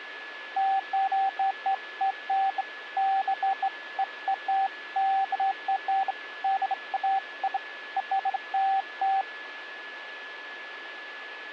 Beeps of irregular length, with a steady whistle near 1710 Hz. There is no code.